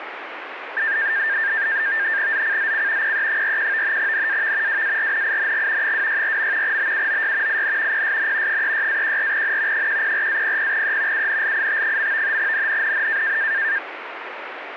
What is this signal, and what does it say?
NAVTEX (SITOR-B), 100 baud, 170 Hz shift, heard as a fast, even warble, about 1700 Hz centre, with radio static. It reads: ZCZC PE41 NAV WARNING 264. BUOY IN PSN 36-14N 104-00E UNLIT. NNNN